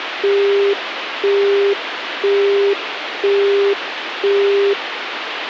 Telephone call progress tone (single-tone plan, as in Europe, Japan and elsewhere), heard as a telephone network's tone, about 400 Hz, 0.5 s on and 0.5 s off, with phone line noise. Busy tone.